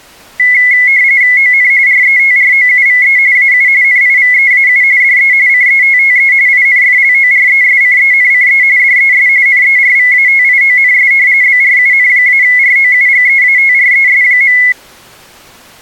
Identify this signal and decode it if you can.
RTTY (45.45 baud, 170 Hz shift), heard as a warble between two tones, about 2100 Hz centre. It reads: ON RETROUVE AU NIVEAU DE CETTE INFLORESCENCE DES NERVATIONS BRUN-ROUGEATRES.